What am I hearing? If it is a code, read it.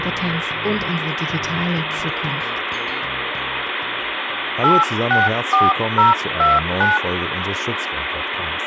DTMF, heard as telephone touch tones, dialled by hand, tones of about 180 ms, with phone line noise. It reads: 864029